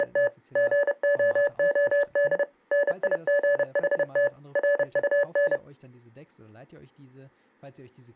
Morse code, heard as electronic beeps, machine-sent, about 30 wpm, 570 Hz, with speech in German. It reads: … GOOD NIGHT RUN